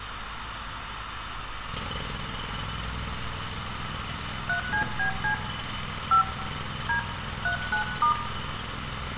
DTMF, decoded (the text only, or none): 3CBC 5 D 39*